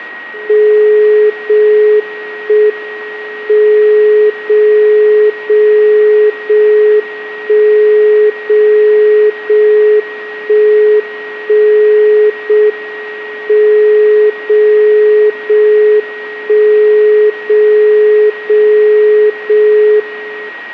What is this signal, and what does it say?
Radio time signal (JJY), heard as a tone whose level steps once a second, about 420 Hz, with a steady whistle near 1890 Hz. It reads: 0 1 M 0 0 0 1 0 0 1 1 0 M 0 0 1 0 0 0 1